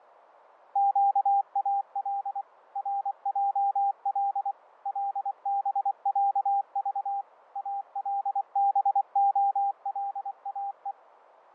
Morse code (Arabic alphabet), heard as a keyed tone, machine-sent, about 24 wpm, 800 Hz, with fading. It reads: قال رجل لبعض البخلاء